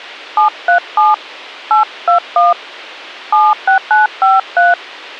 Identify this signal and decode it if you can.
DTMF, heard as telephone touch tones, dialled by hand, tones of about 160 ms. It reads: 737 821 76953